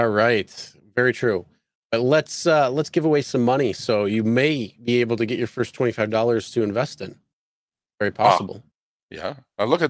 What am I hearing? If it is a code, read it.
Speech in English. There is no code.